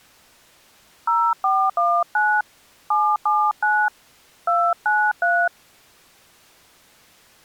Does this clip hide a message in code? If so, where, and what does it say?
Yes: DTMF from 1.1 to 5.5 s, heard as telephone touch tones, dialled by hand, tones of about 260 ms. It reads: 0419 779 293